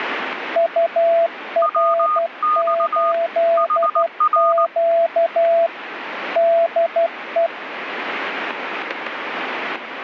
Morse code, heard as two keyed tones, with radio static. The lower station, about 12 wpm, 670 Hz: UR8Q DE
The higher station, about 19 wpm, 1230 Hz: WX HR